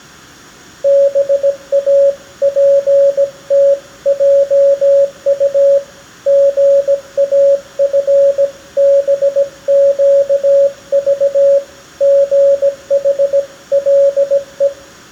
Morse code (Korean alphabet), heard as a keyed tone, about 17 wpm, 560 Hz, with room echo. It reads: 도저히 손댈 수가